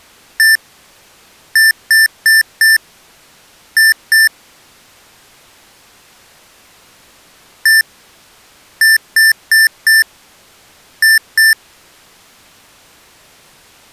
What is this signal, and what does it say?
Beep code, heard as beeps from a small speaker, played twice, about 1800 Hz. 1-4-2. In Phoenix BIOS tables: parity failure in the first 64 KB of memory.